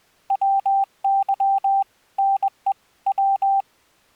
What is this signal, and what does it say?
Morse code (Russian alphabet), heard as a keyed tone, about 21 wpm, 780 Hz. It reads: ВЫ НЕ В